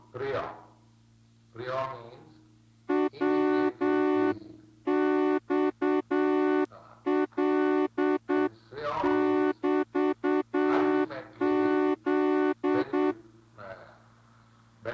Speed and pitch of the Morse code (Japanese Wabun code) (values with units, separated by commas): 8 wpm